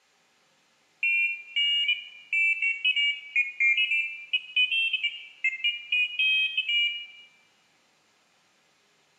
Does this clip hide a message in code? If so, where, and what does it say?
No, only pairs of high tones at irregular times, with room echo.